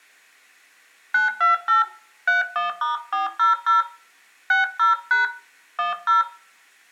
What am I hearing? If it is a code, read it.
DTMF, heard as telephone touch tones, dialled by hand, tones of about 140 ms, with room echo. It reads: 928 31*400 60# 10